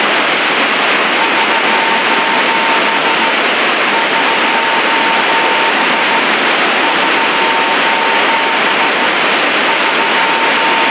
Morse code, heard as a keyed tone, hand-sent with a straight key, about 15 wpm, 910 Hz, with heavy radio static. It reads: <SOS> <SOS> <SOS> …